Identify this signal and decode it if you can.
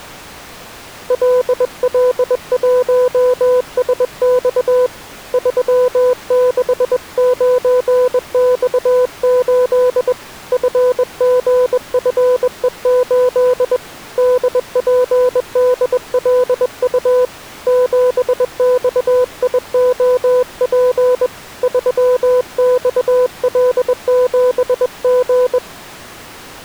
Morse code, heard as a keyed tone, hand-sent with a bug key, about 21 wpm, 500 Hz. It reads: LL1SX 369X8 FGFE8 DPDLU 7XIOP 3XL7G